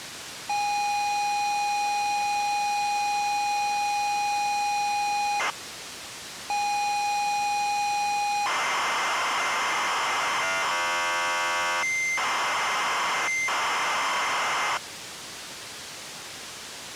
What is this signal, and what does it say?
ZX Spectrum tape loading, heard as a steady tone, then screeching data, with tape hiss.